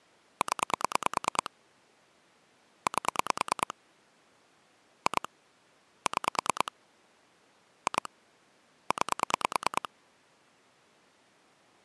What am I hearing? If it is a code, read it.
Pulse dialling, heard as clicks on a phone line, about 9 pulses a second. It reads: 0 8 2 6 2 9